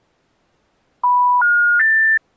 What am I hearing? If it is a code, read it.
Telephone call progress tone (North American plan), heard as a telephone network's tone, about 980, 1430, 1800 Hz. Special information tone.